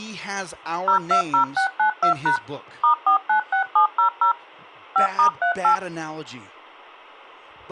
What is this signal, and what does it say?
DTMF, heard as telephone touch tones, dialled by machine, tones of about 100 ms, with speech in English. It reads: 020692# *496700 5*38